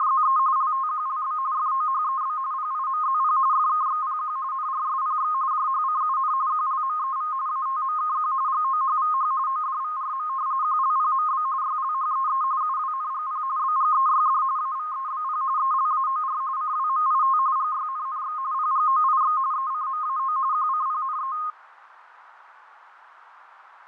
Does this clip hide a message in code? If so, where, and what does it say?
Yes: RTTY (45.45 baud, 170 Hz shift) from 0.0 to 21.5 s, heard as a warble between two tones, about 1150 Hz centre, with radio static and fading. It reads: … LTQLB FOHEB PIMZP FKXPQ NRSPX JHCUN QLMEV ATMKQ GOHVH ODVRM QLPMB YLHEE UWNGP BGEYD AVEBP ELAOR CWMIT GYNNX PGOIX ECMAO QCPNE